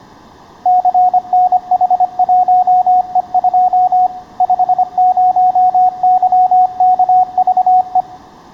Morse code, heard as a keyed tone, machine-sent, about 25 wpm, 730 Hz, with room echo. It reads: CNH1E2 50YKVE